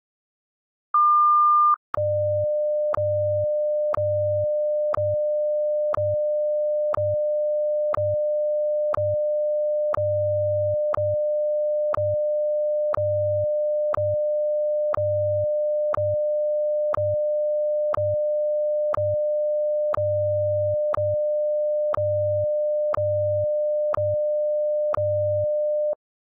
Radio time signal (WWVH, Hawaii), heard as ticks, one a second.